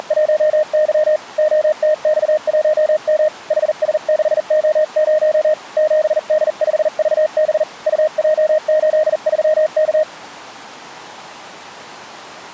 Morse code, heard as a keyed tone, hand-sent with a bug key, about 40 wpm, 620 Hz. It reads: … OTX1M HS6O0 7D5VB UJ83K